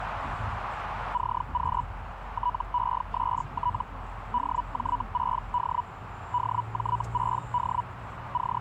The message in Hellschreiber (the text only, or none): CQ TEST DJ6D DJ6D …